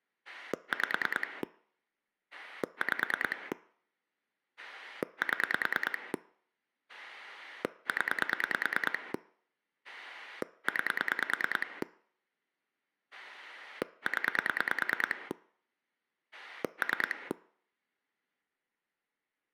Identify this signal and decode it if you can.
Pulse dialling, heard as a rotary dial, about 9 pulses a second. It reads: 5 5 7 0 9 0 3